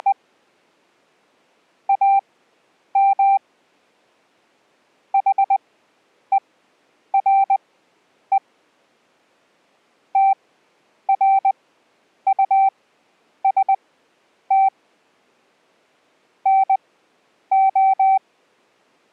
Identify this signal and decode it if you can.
Morse code, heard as a keyed tone, machine-sent, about 20 wpm, spaced as for 9 wpm, 780 Hz. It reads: … AM HERE TRUST NO